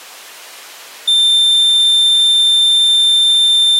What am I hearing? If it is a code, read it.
A steady tone. There is no code.